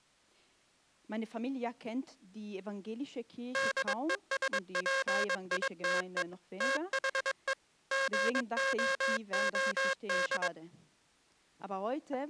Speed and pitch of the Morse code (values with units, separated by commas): 22 wpm